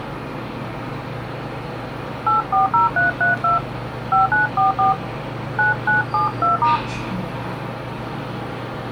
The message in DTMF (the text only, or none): 840332 5944 9972*